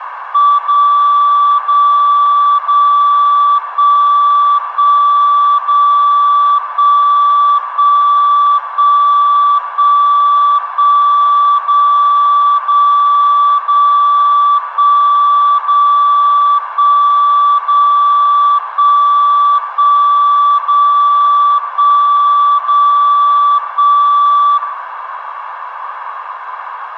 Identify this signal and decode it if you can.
Radio time signal (DCF77), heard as a tone whose level steps once a second, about 1160 Hz, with radio static, a narrow filter and room echo. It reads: 0 0 0 1 1 0 1 1 1 1 1 0 0 0 1 0 1 0 1 1 0 1 0 1